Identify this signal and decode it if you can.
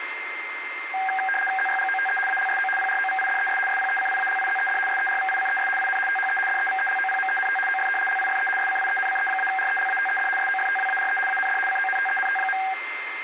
RTTY (75 baud, 850 Hz shift), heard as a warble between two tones, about 1190 Hz centre, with radio static and a steady whistle near 2090 Hz. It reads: ZYGOTE ALSO PROVIDES SPECIALIZED SERVICES IN THE DEVELOPMENT OF LIFE SCIENCE-RELATED SOFTWARE AND CONTENT.